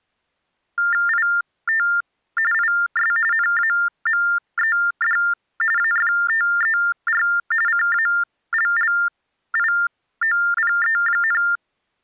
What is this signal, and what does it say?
TTY/TDD text telephone tones (45.45 baud Baudot), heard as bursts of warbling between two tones, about 400 Hz shift, 1600 Hz centre. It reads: IT IS NAMED AFTER CALLIOPE,